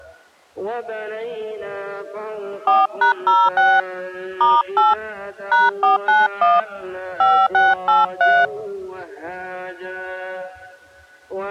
DTMF, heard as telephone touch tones, dialled by hand, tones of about 190 ms. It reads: 4#06 *8 #491 5683